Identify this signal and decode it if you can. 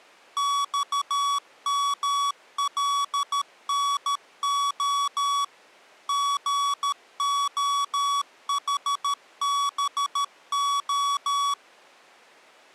Morse code, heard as electronic beeps, machine-sent, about 13 wpm, 1130 Hz. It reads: XMLNO GOHBO